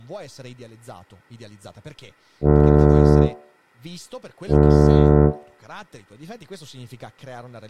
Ship horn signal, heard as a ship's horn, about 70 Hz, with room echo and speech in Italian. 2 short. At sea: I am altering course to port.